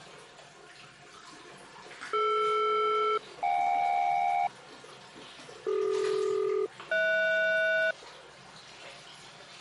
Aircraft SELCAL, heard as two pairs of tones, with the noise of a restroom. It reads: DR-JK CD-HS